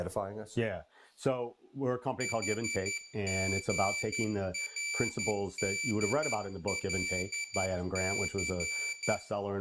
Morse code (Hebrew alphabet), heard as a high beeper, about 11 wpm, 2300 Hz, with room echo and speech in English. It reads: חגרדלס